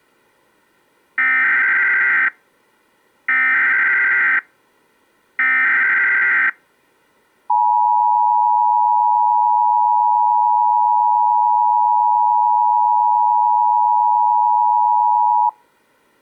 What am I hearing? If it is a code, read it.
Emergency Alert System (SAME) tones (header bursts, then the 853 and 960 Hz attention tone), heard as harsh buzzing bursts, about 520.83 baud.